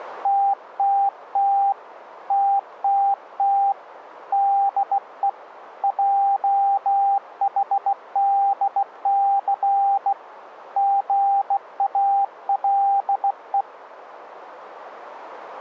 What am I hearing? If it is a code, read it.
Morse code, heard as a keyed tone, hand-sent with a bug key, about 16 wpm, 790 Hz. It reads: TTT TTT DE JHDC GALE